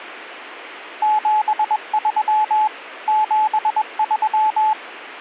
Morse code, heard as a keyed tone, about 21 wpm, 860 Hz. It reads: 73 73